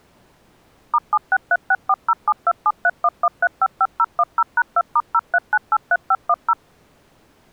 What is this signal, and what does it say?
DTMF, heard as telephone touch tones, dialled by machine, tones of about 50 ms. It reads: *763640727311355010#2*03983510